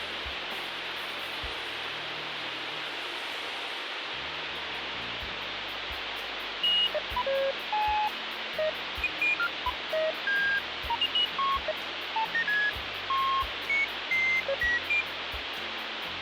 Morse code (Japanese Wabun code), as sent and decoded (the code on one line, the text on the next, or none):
none